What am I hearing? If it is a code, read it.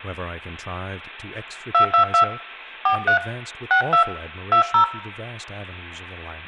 DTMF, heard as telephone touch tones, dialled by hand, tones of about 100 ms, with hum, room echo and speech in English. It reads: 222 43 62 20